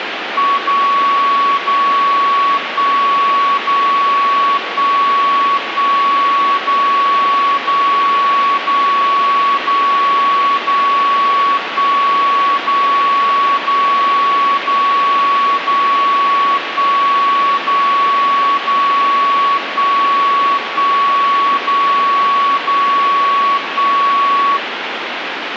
Radio time signal (DCF77), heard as a tone whose level steps once a second, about 1120 Hz, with radio static. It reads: 0 0 1 0 1 1 0 0 0 0 0 1 0 0 0 0 1 0 0 1 1 0 0 1